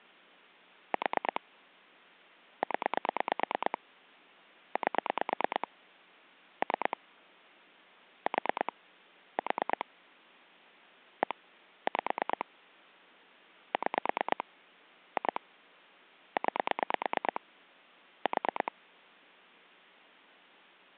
Pulse dialling, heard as clicks on a phone line, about 9 pulses a second. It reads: 4 0 8 3 4 4 1 5 6 2 9 4